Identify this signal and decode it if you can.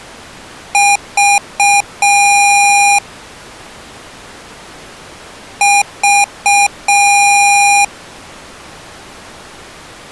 Beep code, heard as beeps from a small speaker, played twice, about 810 Hz. 3 short, 1 long.